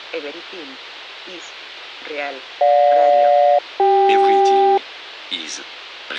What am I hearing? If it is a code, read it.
Aircraft SELCAL, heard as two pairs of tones. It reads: GJ-CK